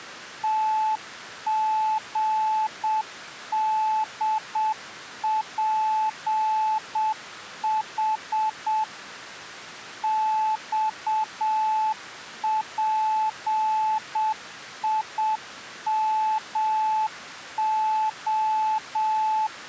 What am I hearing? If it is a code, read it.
Morse code, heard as a keyed tone, machine-sent, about 7 wpm, 870 Hz. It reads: TGDPH XPIMO